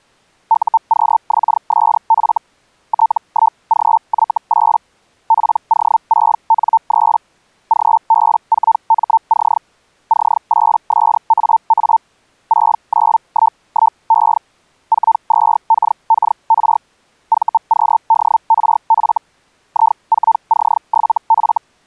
Hellschreiber (Feld-Hell, 122.5 baud), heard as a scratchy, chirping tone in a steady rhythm, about 900 Hz. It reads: UQXSF T1GY8 PO6N3 GB4MC C8SAA 6911E 42KKR VQDRF I4C7F